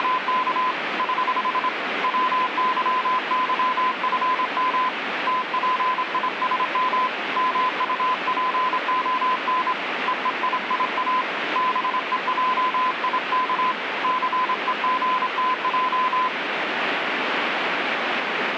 Morse code, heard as a keyed tone, hand-sent with a straight key, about 26 wpm, 1020 Hz, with radio static. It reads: … <HH> WYYFM TPISM MUPON EEIIA BEJIK CEGTJ